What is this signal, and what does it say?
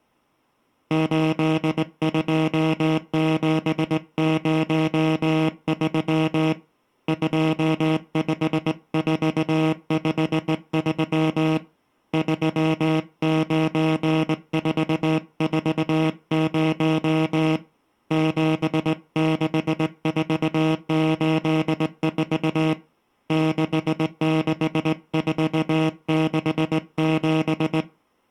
Morse code, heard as a buzzer, hand-sent with a straight key, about 19 wpm. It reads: 82703 25453 39440 76484 66467